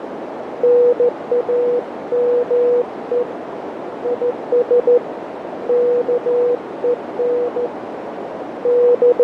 Morse code, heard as a keyed tone, hand-sent with a straight key, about 14 wpm, 490 Hz, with heavy radio static, fading and a narrow filter. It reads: NAME IS KEN …